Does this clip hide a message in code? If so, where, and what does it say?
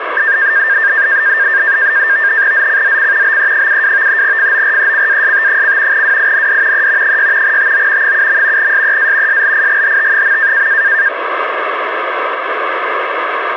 Yes: NAVTEX (SITOR-B), 100 baud, 170 Hz shift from 0.2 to 11.1 s, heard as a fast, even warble, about 1700 Hz centre, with radio static. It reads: ZCZC BE72 FORECAST: WIND E 6 TO 7. SEA SLIGHT.